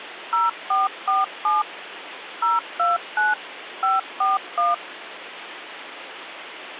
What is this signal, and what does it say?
DTMF, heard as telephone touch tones, dialled by machine, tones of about 170 ms, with phone line noise. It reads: 0447 029 541